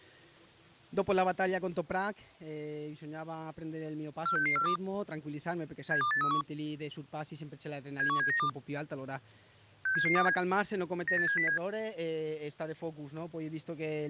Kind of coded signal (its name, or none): five-tone selective call